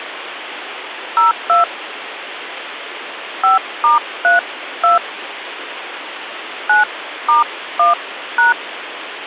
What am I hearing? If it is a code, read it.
DTMF, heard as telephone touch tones, dialled by hand, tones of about 140 ms, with phone line noise. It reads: 02 5*32 9*1#